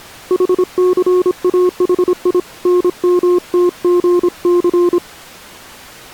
Morse code (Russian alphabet), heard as a keyed tone, hand-sent with a paddle, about 26 wpm, 360 Hz. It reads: ХЦАХИ НМТГЦ